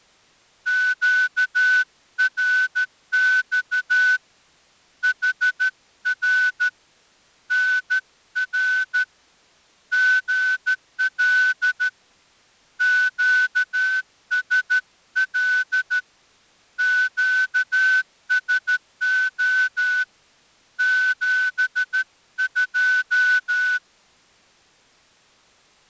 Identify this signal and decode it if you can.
Morse code, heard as a whistle, hand-sent with a straight key, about 13 wpm. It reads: QRX HR NR GL QSL QSO 72